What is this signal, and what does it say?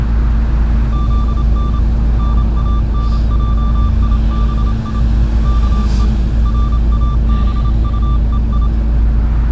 Morse code (Persian alphabet), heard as a keyed tone, hand-sent with a paddle, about 27 wpm, 1180 Hz, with the noise inside a bus. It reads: زن نانجیبی که رابطهی